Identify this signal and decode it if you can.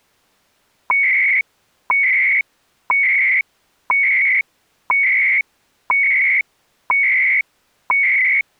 Radio time signal (CHU, Canada), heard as beeps and data bursts, one a second.